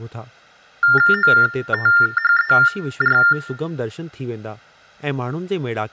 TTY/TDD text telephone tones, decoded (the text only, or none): OTHER